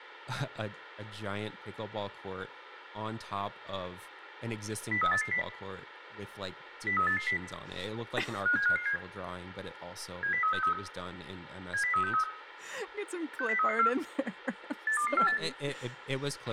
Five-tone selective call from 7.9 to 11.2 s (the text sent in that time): 57557 70363